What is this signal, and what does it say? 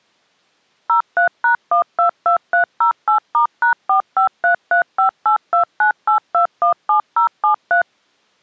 DTMF, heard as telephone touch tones, dialled by machine, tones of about 110 ms. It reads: 03#122308*#453358298217073